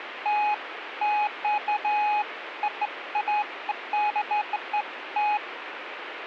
Beeps of irregular length, with radio static. There is no code.